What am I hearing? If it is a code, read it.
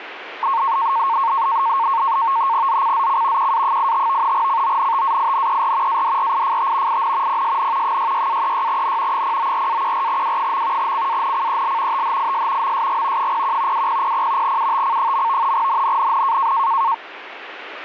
NAVTEX (SITOR-B), 100 baud, 170 Hz shift, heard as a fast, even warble, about 1000 Hz centre, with radio static. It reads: ZCZC QA85 CONTAINER ADRIFT IN PSN 66-36N 094-14W. CANCEL THIS MSG 01 2000 UTC. NNNN